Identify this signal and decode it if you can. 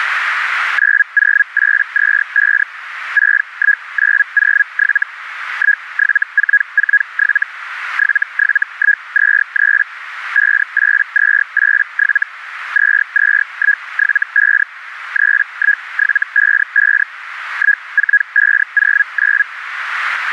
Hellschreiber (Feld-Hell, 122.5 baud), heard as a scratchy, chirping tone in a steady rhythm, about 1650 Hz, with radio static. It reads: 90825 61907 17447 77123 58287 22175 31755 14509